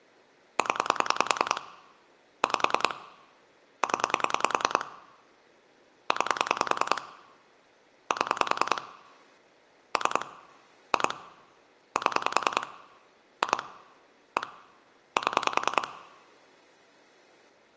Pulse dialling, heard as clicks on a phone line, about 10 pulses a second, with room echo. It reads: 0 5 0 9 7 3 2 7 2 1 7